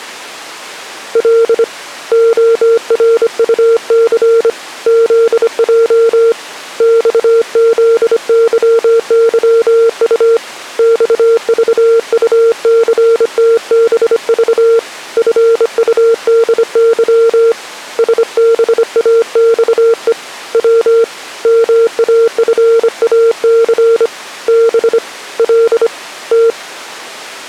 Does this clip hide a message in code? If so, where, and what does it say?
Yes: Morse code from 1.1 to 26.6 s, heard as a keyed tone, hand-sent with a bug key, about 25 wpm, 460 Hz. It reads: L ORUC ZJ XZYYU XVUCTBV FUDY SBAXE W MAFAC B L T